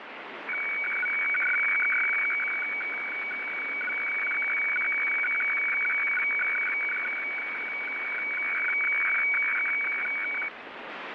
Weather fax (radiofax), 120 lines a minute, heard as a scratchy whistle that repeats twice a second, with radio static.